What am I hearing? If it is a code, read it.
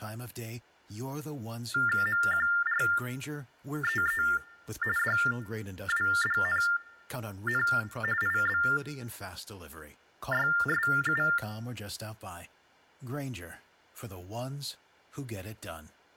TTY/TDD text telephone tones (45.45 baud Baudot), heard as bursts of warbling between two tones, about 400 Hz shift, 1600 Hz centre, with speech in English. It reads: MQREE DWDNN IBYSU